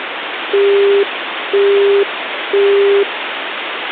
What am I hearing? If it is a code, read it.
Telephone call progress tone (single-tone plan, as in Europe, Japan and elsewhere), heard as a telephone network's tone, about 400 Hz, 0.5 s on and 0.5 s off, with phone line noise. Busy tone.